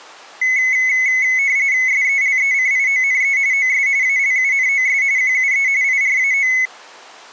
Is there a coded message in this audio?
Yes: RTTY (45.45 baud, 170 Hz shift) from 0.4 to 6.7 s, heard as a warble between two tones, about 2100 Hz centre. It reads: SELECIONE OS ALUNOS QUE IRAO